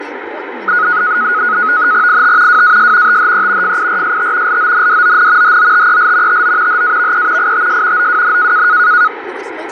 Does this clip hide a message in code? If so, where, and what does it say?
Yes: NAVTEX (SITOR-B), 100 baud, 170 Hz shift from 0.7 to 9.1 s, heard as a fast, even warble, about 1360 Hz centre, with radio static, fading and speech in English. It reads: IT WAS THE FIRST LONDON HOTEL TO HAVE ITS OWN